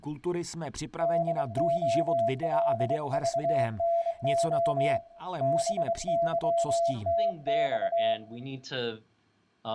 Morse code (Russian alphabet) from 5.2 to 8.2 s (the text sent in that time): БЫТЬ